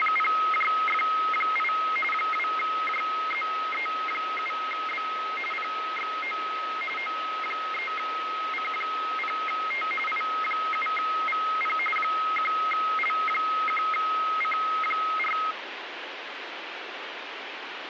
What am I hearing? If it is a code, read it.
RTTY (45.45 baud, 850 Hz shift), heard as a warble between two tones, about 1700 Hz centre, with radio static. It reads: … 2JZE7B PXO O3C0T I7VP 1L1C4